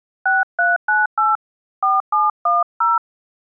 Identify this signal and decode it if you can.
DTMF, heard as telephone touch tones, dialled by hand, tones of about 180 ms. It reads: 6398 4710